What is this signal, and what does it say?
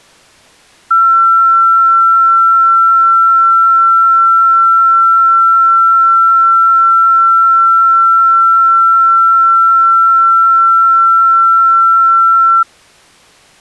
A steady tone. There is no code.